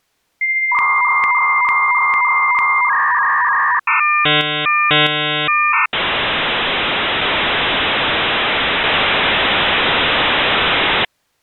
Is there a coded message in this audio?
Yes: dial-up modem handshake (V.34 or later) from 0.4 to 11.0 s, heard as a whistle, warbles, then hiss.